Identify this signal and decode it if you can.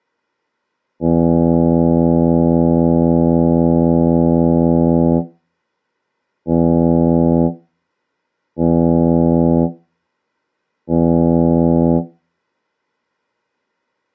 Ship horn signal, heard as a ship's horn, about 80 Hz. 1 long, 3 short. At sea: a vessel under tow in fog.